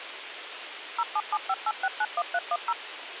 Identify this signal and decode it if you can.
DTMF, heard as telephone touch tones, dialled by machine, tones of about 50 ms, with radio hiss. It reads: 07758691310